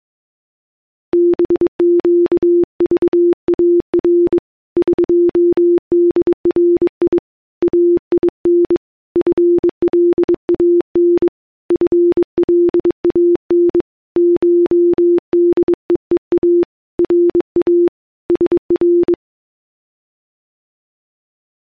Morse code (Persian alphabet), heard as a keyed tone, hand-sent with a bug key, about 22 wpm, 350 Hz. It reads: بگذار قدری این فلان فلان شدهها را سر